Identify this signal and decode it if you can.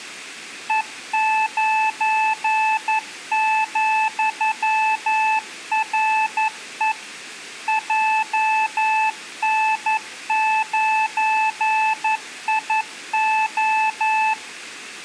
Morse code, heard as a keyed tone, machine-sent, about 11 wpm, 870 Hz, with room echo. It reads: E9,RE JN9IO